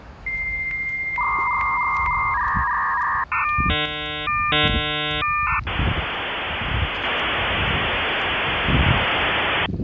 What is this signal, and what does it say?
Dial-up modem handshake (V.34 or later), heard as a whistle, warbles, then hiss, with street noise.